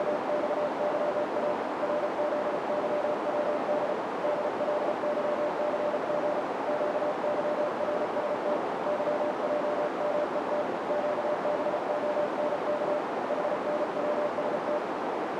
Morse code, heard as a keyed tone, hand-sent with a paddle, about 34 wpm, 600 Hz, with heavy radio static and a narrow filter. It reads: … RZYWD DLYCG QYRST YJMET QBONK HNWST